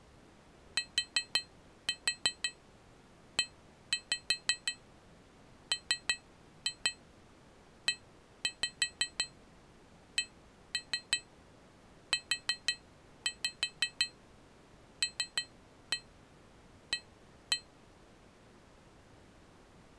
Tap code, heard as taps on glass, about 5 knocks a second. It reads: TEMECULA